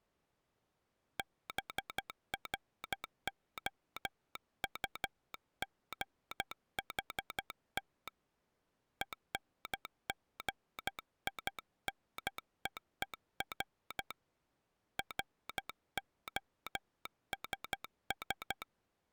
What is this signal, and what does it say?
Morse code, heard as a telegraph sounder, hand-sent with a paddle, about 12 wpm. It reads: BROUGHT ENGINEER ROSS